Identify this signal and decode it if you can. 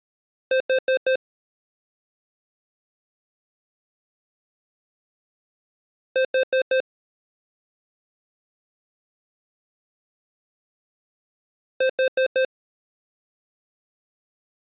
Alarm pattern, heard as an alarm's beeps, played three times, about 520 Hz. Temporal four. Carbon monoxide.